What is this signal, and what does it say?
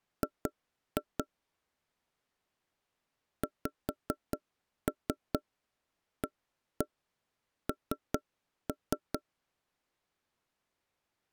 Tap code, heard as knocks on wood, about 4 knocks a second. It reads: G XAN